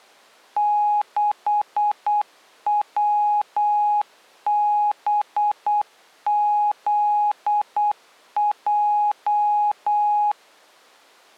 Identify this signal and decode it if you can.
Morse code, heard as a keyed tone, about 8 wpm, 830 Hz. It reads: 6WBZJ